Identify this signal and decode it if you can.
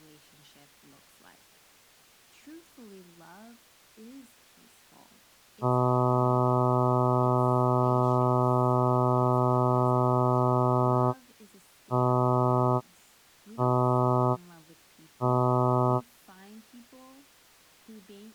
Ship horn signal, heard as a ship's horn, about 120 Hz, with speech in English. 1 long, 3 short. At sea: a vessel under tow in fog.